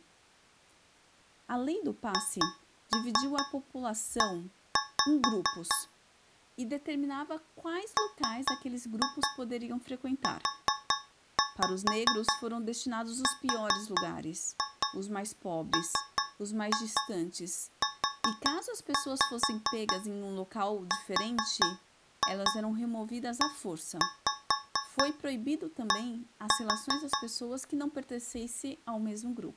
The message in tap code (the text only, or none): HE MURMURED